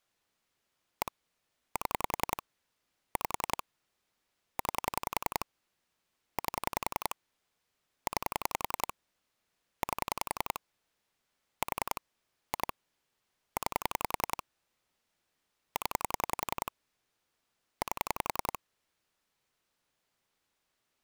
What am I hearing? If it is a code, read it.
Pulse dialling, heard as clicks on a phone line, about 10 pulses a second. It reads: 1 7 5 9 8 9 8 4 2 9 0 8